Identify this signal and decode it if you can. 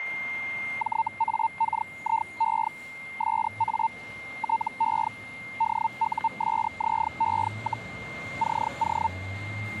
Hellschreiber (Feld-Hell, 122.5 baud), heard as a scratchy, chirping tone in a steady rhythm, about 900 Hz, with static crashes, a steady whistle near 2110 Hz and street noise. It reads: JAKIE SA TE DUSZE, CO